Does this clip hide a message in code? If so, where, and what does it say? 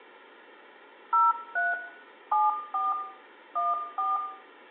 Yes: DTMF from 1.1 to 4.2 s, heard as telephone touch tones, dialled by machine, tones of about 190 ms, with room echo. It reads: 03 74 14